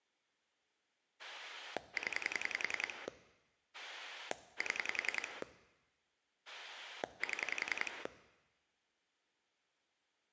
Pulse dialling, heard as a rotary dial, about 10 pulses a second, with room echo. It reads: 0 7 7